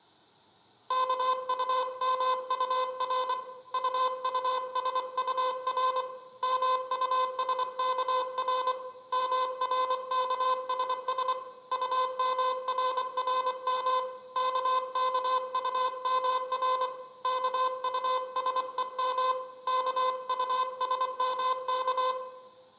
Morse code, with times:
0.9-3.3 KUMUR
3.7-6.0 UUSUR
6.4-8.7 MUSKR
9.1-11.3 MRKSS
11.7-14.0 UMRRM
14.4-16.9 KKUMR
17.2-19.3 KUSEM
19.7-22.1 KUSMK

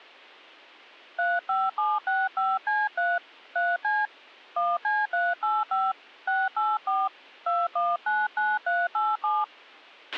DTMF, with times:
1.2-3.2 35765C3
3.6-4.1 3C
4.6-5.9 1C385
6.3-7.1 684
7.5-9.4 2199387

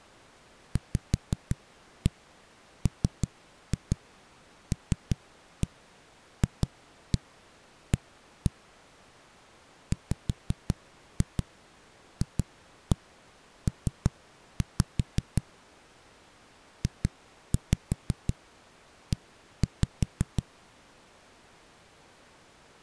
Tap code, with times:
0.8-8.5 VMLFA
9.9-15.4 WFP
16.8-20.4 JE

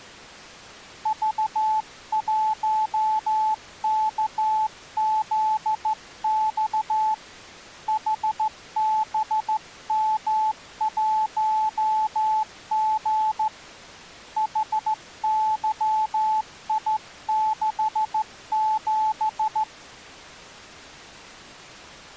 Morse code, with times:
1.1-7.1 V1KZX
7.9-13.5 HBM1G
14.4-19.6 HYI67

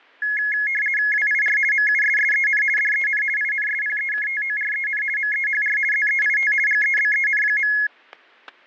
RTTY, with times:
1.1-1.6 WIR
1.7-2.6 MUSSEN
2.8-3.2 DEN
3.4-5.0 INSPEKTOREN
5.2-5.8 MEHR
5.9-6.5 ZEIT
6.7-7.7 GEBEN.

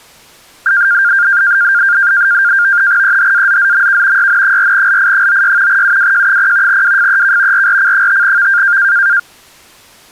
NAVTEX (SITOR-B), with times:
3.0-4.3 EHAZZMK
4.2-5.8 YN4LI96
5.7-6.8 UWJ0
6.7-7.7 WFEK
7.5-8.8 RRC5V

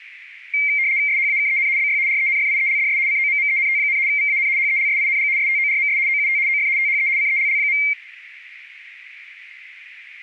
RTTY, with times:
1.1-1.7 SHAKEN
1.8-2.0 BY
2.1-3.0 RENFIELDS
3.1-4.0 COMMENT,
4.1-4.5 VAN
4.6-5.3 HELSING
5.4-6.0 STORMS
6.1-6.4 OUT
6.5-6.7 OF
6.8-7.1 THE
7.2-7.8 CELL.

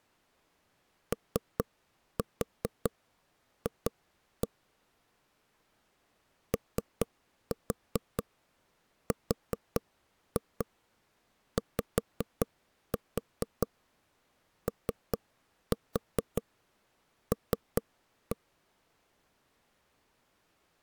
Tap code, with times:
1.1-4.5 OF
6.5-18.4 ORYOL

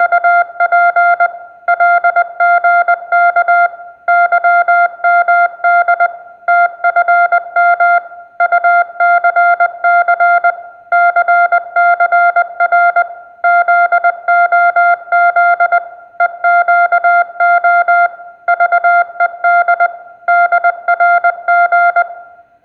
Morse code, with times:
0.0-1.3 …
1.7-3.7 LGK
4.1-6.1 YMD
6.5-8.0 TFM
8.4-10.5 UCC
10.9-13.0 CCR
13.4-15.8 ZOZ
16.2-18.1 EQO
18.5-19.9 VED
20.3-22.0 DRG

